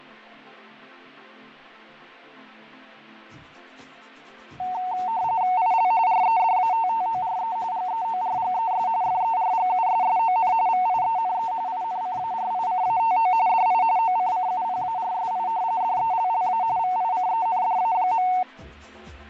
RTTY (45.45 baud, 170 Hz shift), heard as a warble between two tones, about 820 Hz centre, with fading. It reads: IL REDATTORE GEORGES FERGUSSON VIENE INCARICATO DI OCCUPARSI DELLA VICENDA.